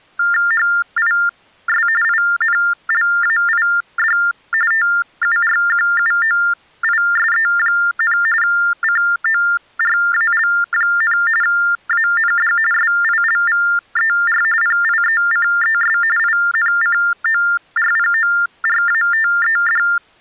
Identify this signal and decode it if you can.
TTY/TDD text telephone tones (45.45 baud Baudot), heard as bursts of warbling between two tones, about 400 Hz shift, 1600 Hz centre. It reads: HIS INLAID TURQUOISE, CORAL, AND SILVER PIECES INCORPORATED